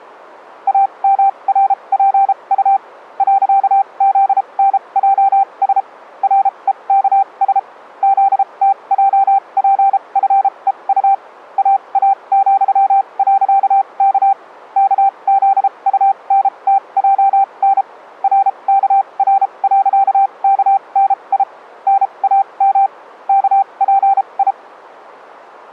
Morse code, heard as a keyed tone, machine-sent, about 33 wpm, spaced as for 26 wpm, 780 Hz. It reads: AMRPU .ZNJS REKS ZTJPFEU AA,.K KZUNTJN RKR.KNI NAM KPI